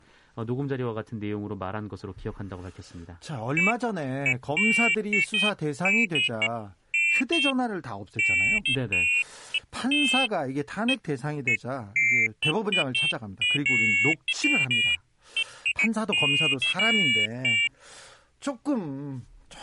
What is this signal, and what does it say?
Pairs of high tones at irregular times, with speech in Korean. There is no code.